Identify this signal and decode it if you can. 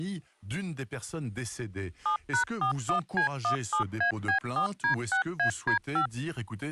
DTMF, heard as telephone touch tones, dialled by machine, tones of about 100 ms, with speech in French. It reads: 7#41C17AB4D6AD5